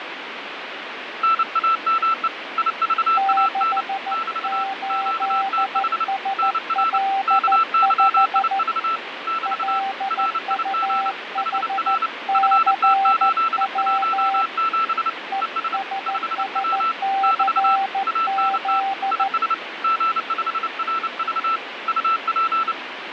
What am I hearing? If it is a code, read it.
Morse code, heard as two keyed tones, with radio static and fading. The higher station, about 29 wpm, 1330 Hz: NAME IVAN <BT> QTH NR KYIV <BT> RIG HR FT817 ES 5W <BT> ANT IS G5RV UP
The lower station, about 14 wpm, 780 Hz: 68SL5 LUHCW ESSCZ